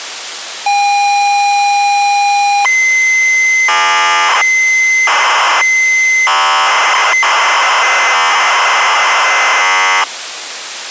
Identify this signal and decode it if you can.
ZX Spectrum tape loading, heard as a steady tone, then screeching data, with tape hiss.